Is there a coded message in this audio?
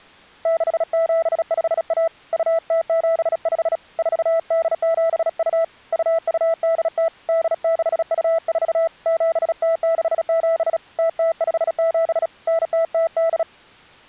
Yes: Morse code (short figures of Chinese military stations) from 0.4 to 13.5 s, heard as a keyed tone, hand-sent with a bug key, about 36 wpm, 660 Hz. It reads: 6751 2075 4872 2280 8624 7067 0057 9008